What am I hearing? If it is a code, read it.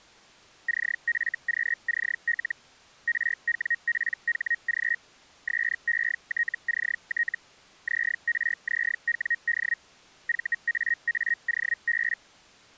Hellschreiber (Feld-Hell, 122.5 baud), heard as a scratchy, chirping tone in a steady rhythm, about 1900 Hz. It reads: CFQCL RWPHG SETCT ZRZWD VAAOB